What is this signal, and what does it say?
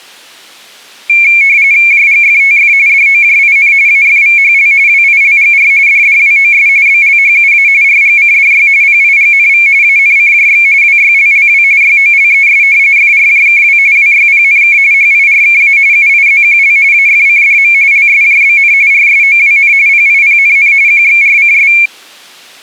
RTTY (45.45 baud, 170 Hz shift), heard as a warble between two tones, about 2300 Hz centre. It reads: JGFTF DOJIN AFVHL WILGR DDWOS BLHUA RGCDY PIGNV ANCJX WYLLW YOLES FRJKW WYPNK HIRKA UIZQL AFCDM LSJBN RSOWN PIPNN QXRCS